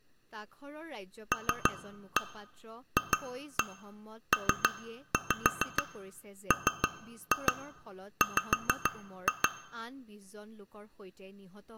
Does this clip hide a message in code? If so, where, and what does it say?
Yes: tap code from 1.3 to 9.5 s, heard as taps on glass, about 6 knocks a second, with speech in Assamese. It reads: LFPMW